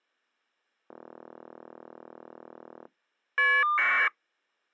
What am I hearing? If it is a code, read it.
Caller ID data burst, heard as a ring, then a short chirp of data, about 1200 baud.